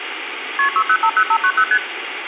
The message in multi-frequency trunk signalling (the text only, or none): KP 6050590 ST